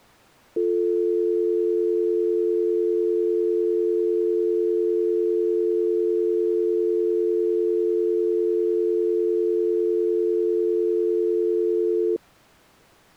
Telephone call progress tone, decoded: dial tone

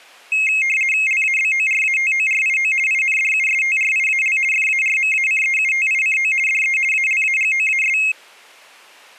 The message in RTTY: LABORATORIO INDUSTRIAL FARMACEUTICO DE ALAGOAS

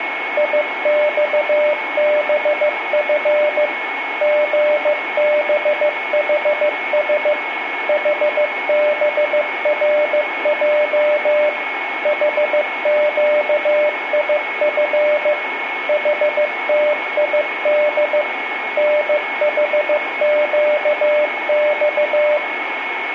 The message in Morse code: IXBF GBHS HBRJ HQIF HTID NHQX

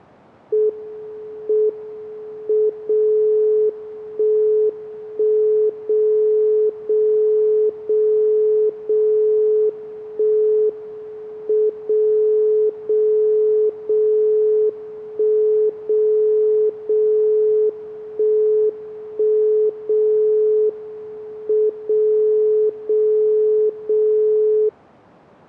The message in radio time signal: M M 0 1 1 0 0 0 0 1 M 0 0 0 1 0 0 1 1 0 M 0 0 0

